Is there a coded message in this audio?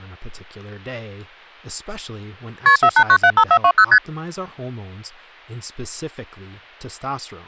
Yes: multi-frequency trunk signalling (R1, as on North American trunks) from 2.7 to 4.0 s, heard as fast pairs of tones, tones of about 70 ms, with speech in English. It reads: KP 48975420 ST